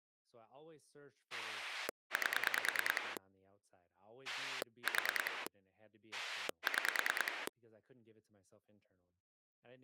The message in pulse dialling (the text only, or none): 8 4 6